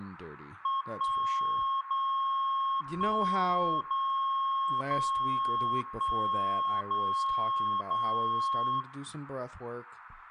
Radio time signal (DCF77), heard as a tone whose level steps once a second, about 1080 Hz, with room echo and speech in English. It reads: 1 0 1 0 0 1 0 0